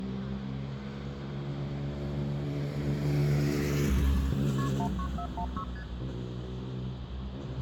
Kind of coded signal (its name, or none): multi-frequency trunk signalling